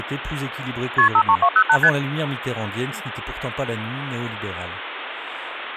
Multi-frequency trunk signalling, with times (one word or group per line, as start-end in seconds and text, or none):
1.0-1.1 KP
1.1-1.8 53208
1.8-1.9 ST